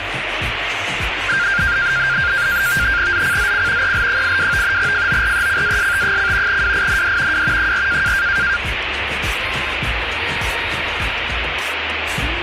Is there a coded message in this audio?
Yes: NAVTEX (SITOR-B), 100 baud, 170 Hz shift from 1.3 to 8.6 s, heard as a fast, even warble, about 1500 Hz centre, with radio static. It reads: ZCZC EL82 FORECAST: WIND W 4